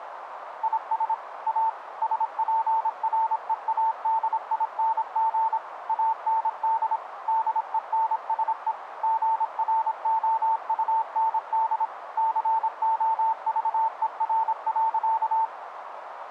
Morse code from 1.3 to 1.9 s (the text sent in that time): A